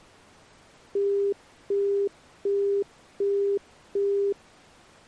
Telephone call progress tone (as in the UK, Australia and similar networks), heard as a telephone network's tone, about 400 Hz, 0.375 s on and 0.375 s off. Busy tone.